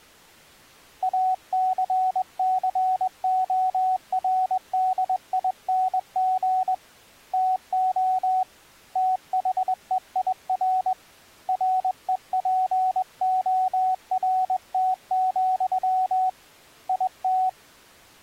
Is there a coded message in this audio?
Yes: Morse code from 1.0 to 17.6 s, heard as a keyed tone, hand-sent with a straight key, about 21 wpm, 750 Hz. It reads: ACCORDING TO THEIR REPORT, IT